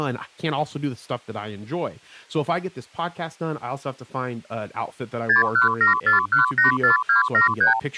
Multi-frequency trunk signalling (R2, with the far end's replies), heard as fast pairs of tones, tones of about 130 ms, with speech in English. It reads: 6174184273